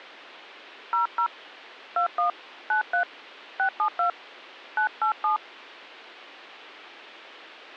DTMF, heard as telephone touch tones, dialled by hand, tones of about 100 ms. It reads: 00 21 93 672 987